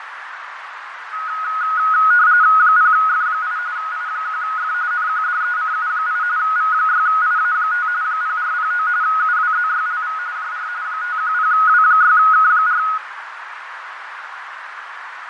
RTTY (45.45 baud, 170 Hz shift), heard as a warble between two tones, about 1360 Hz centre, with radio static, fading and a narrow filter. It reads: 0F8 I1F NQDECU8 V6IA5 0409 UWZYLV JR 510W6K4